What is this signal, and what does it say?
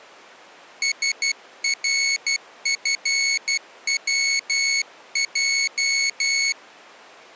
Morse code, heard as a high beeper, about 12 wpm, 2200 Hz. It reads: SRFWJ